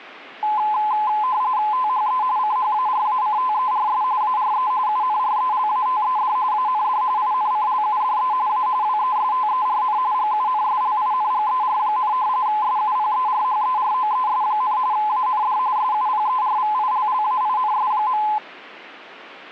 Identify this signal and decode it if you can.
RTTY (45.45 baud, 170 Hz shift), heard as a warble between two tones, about 940 Hz centre. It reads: THE CHARACTERS ARE UNRELATED AND INCLUDE A WESTERN GUNSLINGER, SUPERHEROES, AND SUPERVILLAINS.